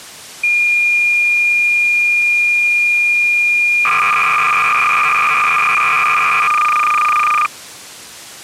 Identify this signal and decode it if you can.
Cassette data (Kansas City type), 300 baud, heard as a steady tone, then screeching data.